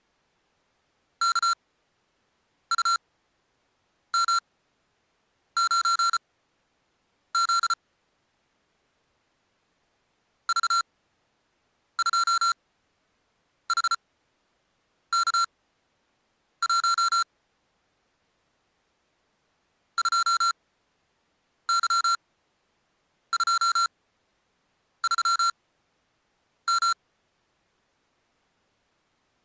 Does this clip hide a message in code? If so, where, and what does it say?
Yes: Morse code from 1.2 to 27.0 s, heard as electronic beeps, machine-sent, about 34 wpm, spaced as for 7 wpm, 1370 Hz. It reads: KUM9Z V2HK1 2Y23M